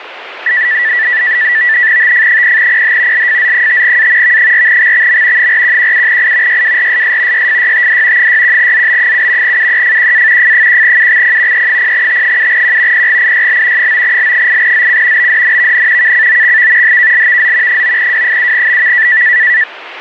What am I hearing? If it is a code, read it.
NAVTEX (SITOR-B), 100 baud, 170 Hz shift, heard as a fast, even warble, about 1850 Hz centre, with radio static. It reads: TF0PH LFZ5A V4XXM 4117I YWRSS YFYTD 61ZB7 UEFQA F1UXP E0T7Q PGIYL 9L8ZC BDNVN KCOXV HKLVZ 9W7BV